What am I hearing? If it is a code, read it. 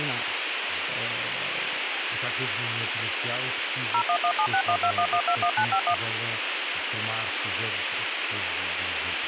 DTMF, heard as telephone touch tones, dialled by machine, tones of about 80 ms, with radio hiss and speech in Portuguese. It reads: 01176121121951